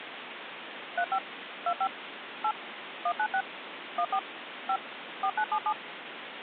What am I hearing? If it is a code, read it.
DTMF, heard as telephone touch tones, dialled by machine, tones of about 70 ms, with phone line noise. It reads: 35 25 8 196 14 5 4977